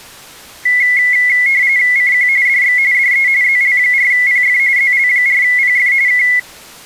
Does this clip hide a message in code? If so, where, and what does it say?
Yes: RTTY (45.45 baud, 170 Hz shift) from 0.7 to 6.4 s, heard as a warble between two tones, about 2050 Hz centre. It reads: CQ DX DE ZL4PF ZL4PF K